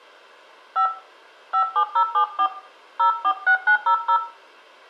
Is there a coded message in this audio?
Yes: DTMF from 0.8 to 4.2 s, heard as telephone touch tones, dialled by hand, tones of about 90 ms, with room echo. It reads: 5 57074 046900